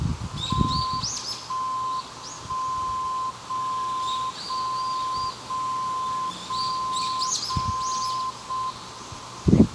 Radio time signal (JJY), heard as a tone whose level steps once a second, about 1040 Hz, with radio static, a narrow filter and the noise of a park. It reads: 1 1 0 0 0 0 0 0 M